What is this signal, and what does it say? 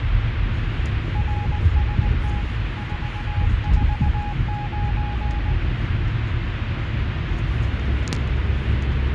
Morse code, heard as a keyed tone, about 19 wpm, 830 Hz, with heavy radio static and the noise inside a car. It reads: RST 449